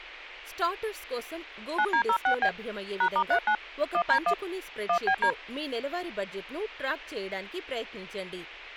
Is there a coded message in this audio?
Yes: DTMF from 1.8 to 5.3 s, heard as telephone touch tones, dialled by hand, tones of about 80 ms, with speech in Telugu. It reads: 9D06B #*39 1D1 1BD